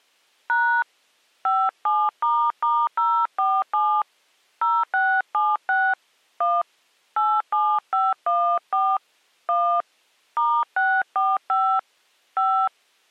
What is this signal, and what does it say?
DTMF, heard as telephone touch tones, dialled by hand, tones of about 260 ms. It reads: # 57**047 0676 1 87514 1 *645 5